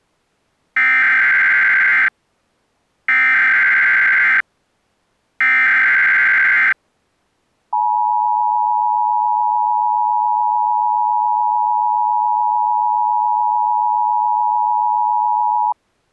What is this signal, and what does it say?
Emergency Alert System (SAME) tones (header bursts, then the 853 and 960 Hz attention tone), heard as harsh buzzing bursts, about 520.83 baud.